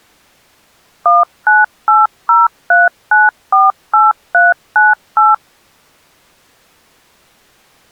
DTMF, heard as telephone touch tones, dialled by machine, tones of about 180 ms. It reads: 19803948398